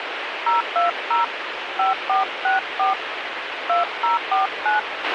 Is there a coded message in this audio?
Yes: DTMF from 0.5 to 4.8 s, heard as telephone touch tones, dialled by hand, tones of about 140 ms, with radio hiss and a squelch burst at the end. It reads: 020 5464 2049